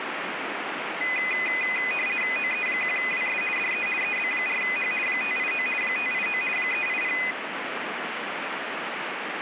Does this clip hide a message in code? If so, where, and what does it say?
Yes: RTTY (50 baud, 450 Hz shift) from 1.0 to 7.3 s, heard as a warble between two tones, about 2250 Hz centre, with radio static. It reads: OE1WS DE EB4H 589 589 380